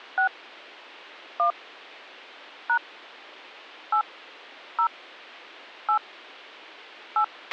DTMF, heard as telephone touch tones, dialled by hand, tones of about 80 ms, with a squelch burst at the end. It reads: 6 1 # 8 0 8 8